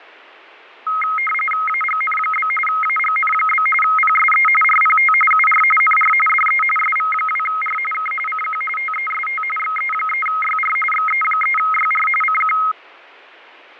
RTTY (45.45 baud, 850 Hz shift), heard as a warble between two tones, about 1700 Hz centre, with fading. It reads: AGN? AGN? PSE RPT UR NR DE SV2R K CQ TEST XE3YR XE3YR CQ